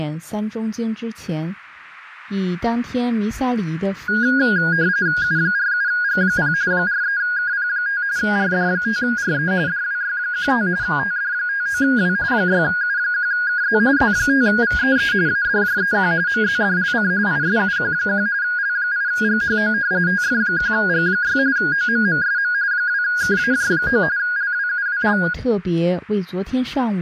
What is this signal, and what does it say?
RTTY (45.45 baud, 170 Hz shift), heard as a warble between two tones, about 1550 Hz centre. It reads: U47G0 43KP5 RD5RE DWY15 TD59W 6U1KZ Z5VEE ADJEQ MZDLC ISUQ1 L8GHO TF1G6 OMMSM 2KAJ9 LWUWL